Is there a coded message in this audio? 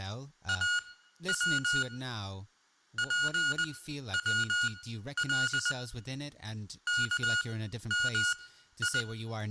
Yes: Morse code (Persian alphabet) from 0.4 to 9.1 s, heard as electronic beeps, machine-sent, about 20 wpm, spaced as for 12 wpm, 1440 Hz, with room echo and speech in English. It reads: او پول کمی